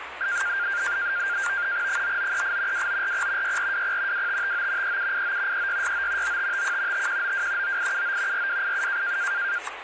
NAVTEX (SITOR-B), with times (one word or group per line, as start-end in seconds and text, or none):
1.9-2.9 9938
2.7-3.6 2940
3.4-4.3 6420
4.1-5.0 2559
4.8-5.7 3789
5.5-6.4 3669
6.2-7.1 9551
6.9-7.8 5192
7.6-8.5 9879
8.3-9.2 4287